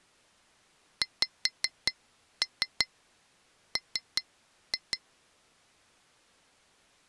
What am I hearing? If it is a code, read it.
Tap code, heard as taps on glass, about 5 knocks a second. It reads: XM